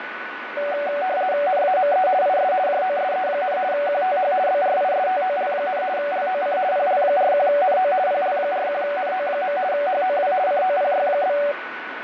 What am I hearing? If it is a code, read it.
RTTY (50 baud, 170 Hz shift), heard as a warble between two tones, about 660 Hz centre, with radio static and a steady whistle near 1490 Hz. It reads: NAME IS JOSE, QTH BRISTOL, LOC PL41NO PL41NO. HOW COPY?